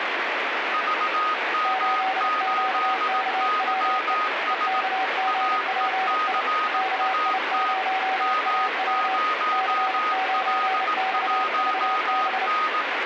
Morse code, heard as two keyed tones, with heavy radio static. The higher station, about 18 wpm, 1250 Hz: VM8YS AECAT M0L1N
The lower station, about 30 wpm, 760 Hz: 8QKWE EKGPI KI0AW C9XVB